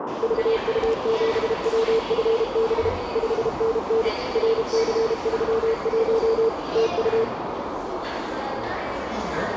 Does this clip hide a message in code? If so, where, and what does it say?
Yes: Morse code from 0.2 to 7.3 s, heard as a keyed tone, machine-sent, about 32 wpm, 450 Hz, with radio static, a narrow filter and the noise of a crowd indoors. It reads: VU7WFB 5NN RC31 TU